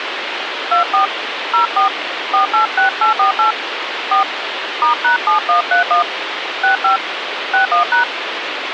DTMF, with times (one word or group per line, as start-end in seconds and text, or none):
0.7-1.1 24
1.5-1.9 04
2.3-3.5 486848
4.1-4.2 4
4.8-6.0 *#7131
6.6-7.0 65
7.5-8.0 61#